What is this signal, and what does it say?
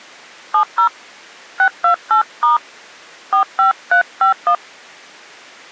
DTMF, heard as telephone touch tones, dialled by hand, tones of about 110 ms. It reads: 70 628* 45351